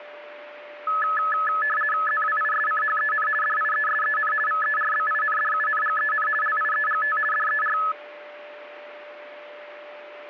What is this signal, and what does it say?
RTTY (50 baud, 450 Hz shift), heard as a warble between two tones, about 1500 Hz centre, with a steady whistle near 590 Hz. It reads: ZWISCHEN DIESEN VERBINDUNGEN LIEGT DER